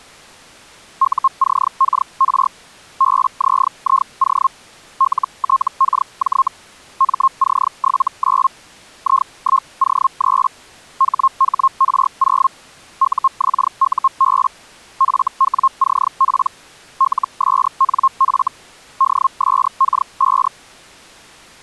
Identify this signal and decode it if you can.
Hellschreiber (Feld-Hell, 122.5 baud), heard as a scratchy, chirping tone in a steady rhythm, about 1070 Hz. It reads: UCKR BZIO LTKJ MC79 I1O3 HHR0 UXUB FWCP LSNF DSK5